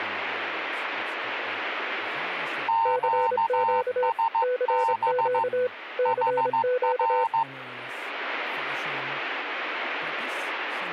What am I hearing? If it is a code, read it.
Morse code, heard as two keyed tones, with speech in English. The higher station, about 15 wpm, 910 Hz: QSB HR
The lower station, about 26 wpm, 500 Hz: CQ CQ CQ